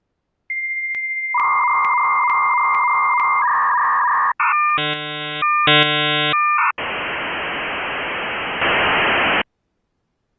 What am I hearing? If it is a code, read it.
Dial-up modem handshake (V.34 or later), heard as a whistle, warbles, then hiss.